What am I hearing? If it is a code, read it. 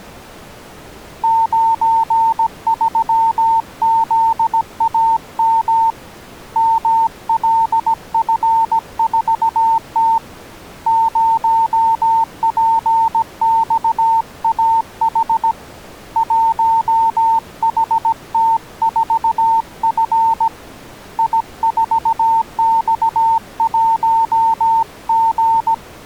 Morse code, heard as a keyed tone, hand-sent with a paddle, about 17 wpm, 900 Hz. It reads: 93ZAM MLF4T 0PXAH 1HT4F I4X1G